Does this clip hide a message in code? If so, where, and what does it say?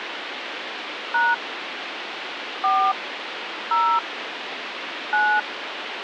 Yes: DTMF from 1.1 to 5.4 s, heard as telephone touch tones, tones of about 250 ms, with phone line noise. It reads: # 4 0 9